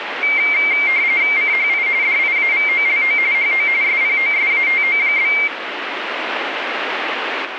RTTY (45.45 baud, 170 Hz shift), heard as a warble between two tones, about 2200 Hz centre, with radio static. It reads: CHI DIAVOLO HO SPOSATO?